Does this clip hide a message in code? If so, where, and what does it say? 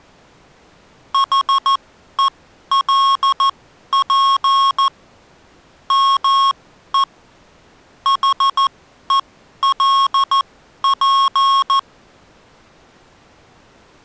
Yes: Morse code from 1.1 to 11.9 s, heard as electronic beeps, machine-sent, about 14 wpm, spaced as for 11 wpm, 1090 Hz. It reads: HELP ME HELP